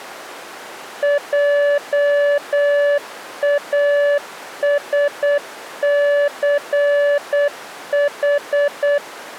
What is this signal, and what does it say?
Morse code, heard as a keyed tone, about 8 wpm, 580 Hz. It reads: JASCH